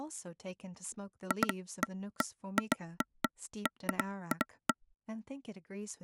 Irregular taps on a table, with speech in English. There is no code.